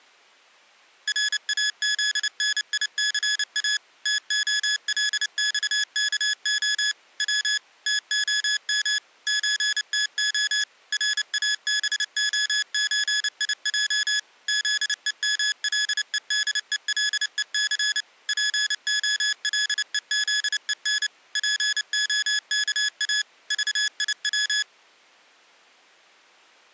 Morse code (Russian alphabet), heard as electronic beeps, machine-sent, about 29 wpm, 1700 Hz. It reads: РАЗНИЦА ТОЛЬКО В ТОМ ЧТО РАБОЧИЙ ЗЕМЛЕДЕЛЕЦ ПОЛЕЗЕН ПОКА ЖИВ